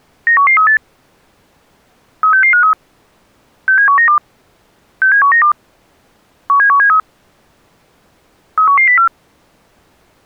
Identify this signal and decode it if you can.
Five-tone selective call (CCIR), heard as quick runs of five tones, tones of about 100 ms. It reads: 91138 36653 67192 67192 17173 31104